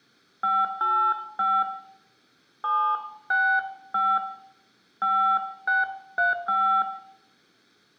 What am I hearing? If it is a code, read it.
DTMF, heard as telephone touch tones, dialled by hand, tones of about 250 ms, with room echo. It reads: 585 765 5635